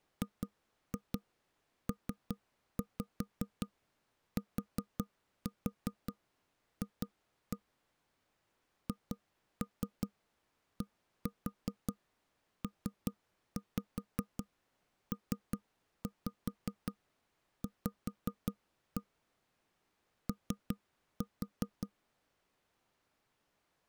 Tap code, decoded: GPTF HDPPV O

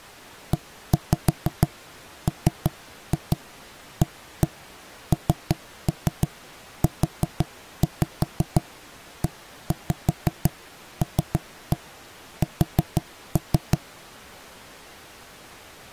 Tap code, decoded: EMANUELS

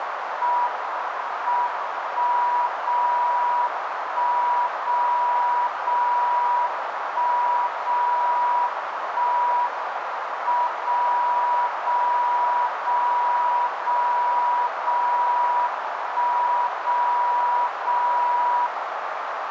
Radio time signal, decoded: M 1 0 1 0 0 1 0 1 M 0 0 0 0 0 1 0 0

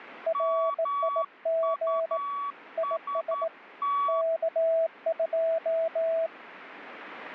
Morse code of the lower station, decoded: RIG IS K2

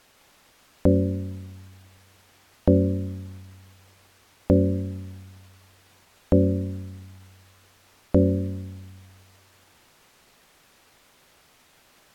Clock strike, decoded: 5

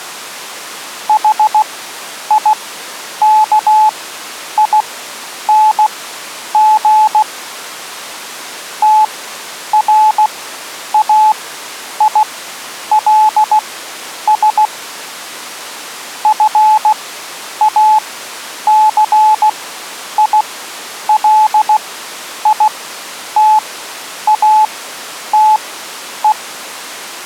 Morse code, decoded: HIKING TRAILS FACILITATE

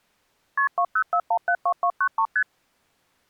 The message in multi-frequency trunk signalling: KP 204172293 ST

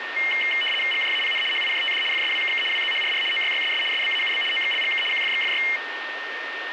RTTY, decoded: GJAPN HIJTD FSWKK WZHRR OYYSS SBAUB OXLGK QFXFY

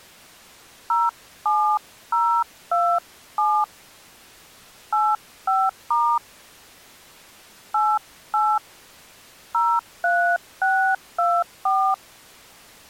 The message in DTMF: 07027 85* 88 03624

